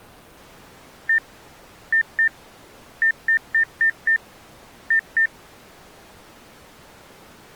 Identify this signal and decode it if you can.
Beep code, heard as beeps, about 1800 Hz. 1-2-5-2.